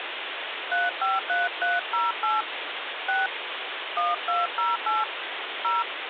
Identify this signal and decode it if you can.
DTMF, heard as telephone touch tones, dialled by hand, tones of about 180 ms, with phone line noise. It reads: 353308 6 1208 0